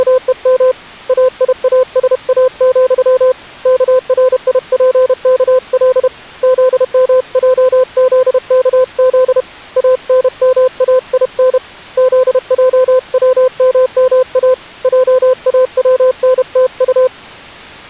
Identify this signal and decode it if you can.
Morse code, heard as a keyed tone, hand-sent with a paddle, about 31 wpm, 510 Hz. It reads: … AIASA, KRIPKL ZMJZKZ ANMAIN ZJWMMA JAWNTU